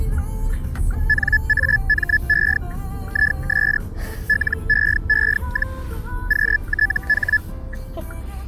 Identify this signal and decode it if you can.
Hellschreiber (Feld-Hell, 122.5 baud), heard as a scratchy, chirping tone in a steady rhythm, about 1700 Hz, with the noise inside a car. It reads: NAME IS LEE, QTH